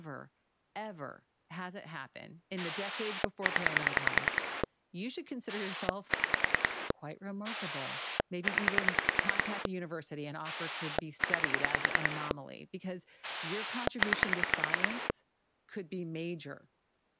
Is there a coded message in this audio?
Yes: pulse dialling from 2.6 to 15.1 s, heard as a rotary dial, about 10 pulses a second, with speech in English. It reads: 0 6 0 9 9